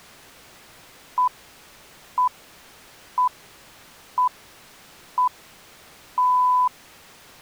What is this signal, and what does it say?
Radio time signal (six pips, as the Greenwich Time Signal), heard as pips.